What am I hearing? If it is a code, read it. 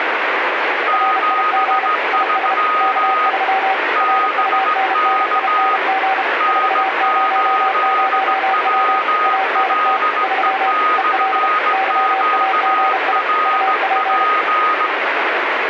Morse code, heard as two keyed tones, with heavy radio static. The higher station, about 17 wpm, 1250 Hz: 73 BK N8WLE/QRP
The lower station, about 32 wpm, 770 Hz: RIG IS K3 RUNNING 400W ANT 3 EL YAGI UP